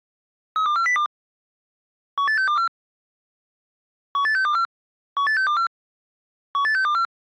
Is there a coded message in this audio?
Yes: five-tone selective call (CCIR) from 0.6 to 7.0 s, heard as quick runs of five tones, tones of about 100 ms. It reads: 32402 18624 18624 18624 18624